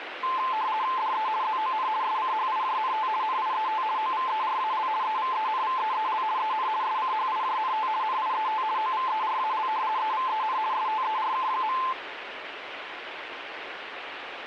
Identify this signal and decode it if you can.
RTTY (50 baud, 170 Hz shift), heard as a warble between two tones, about 960 Hz centre, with radio static. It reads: DE ZON SCHIJNT NIET OVERAL EVENVEEL EN SCHIJNT NIET OVERAL EVEN STERK.